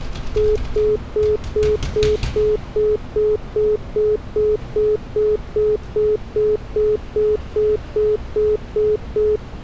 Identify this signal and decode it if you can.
Telephone call progress tone (single-tone plan, as in most of Europe), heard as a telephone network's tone, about 420 Hz, 0.2 s on and 0.2 s off, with street noise. Congestion tone.